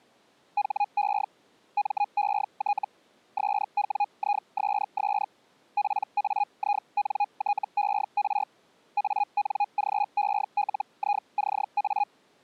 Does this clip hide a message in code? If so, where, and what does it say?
Yes: Hellschreiber (Feld-Hell, 122.5 baud) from 0.6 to 12.1 s, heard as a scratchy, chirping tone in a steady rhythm, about 820 Hz. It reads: HE MET SWISS PAINTER ANGELICA